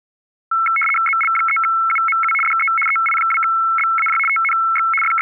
RTTY (75 baud, 850 Hz shift), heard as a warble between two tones, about 1750 Hz centre. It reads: ZL3UMU DE EI2BAJ TNX …